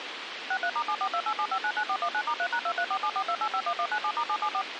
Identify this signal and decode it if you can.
DTMF, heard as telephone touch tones, dialled by machine, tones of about 70 ms, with radio hiss. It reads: 63*74287599419*3#234742851197*774